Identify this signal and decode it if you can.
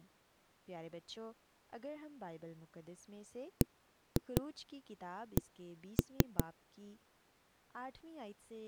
Tap code, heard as knocks on wood, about 5 knocks a second, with speech in Urdu. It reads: BC